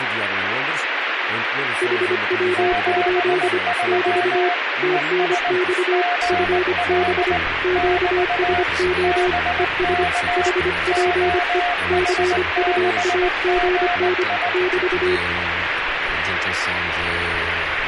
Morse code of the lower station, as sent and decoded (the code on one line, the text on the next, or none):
.... .-- ..--.. / -...- / - -. -..- / ..-. -... / --.- ... --- / . ... / .... .--. . / -.-. ..- .- --. -. / -...-
HW? <BT> TNX FB QSO ES HPE CUAGN <BT>